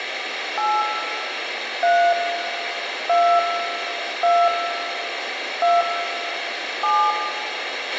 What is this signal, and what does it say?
DTMF, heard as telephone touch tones, dialled by hand, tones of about 250 ms, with radio hiss, a squelch burst at the end and room echo. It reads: 8 3 2 2 2 7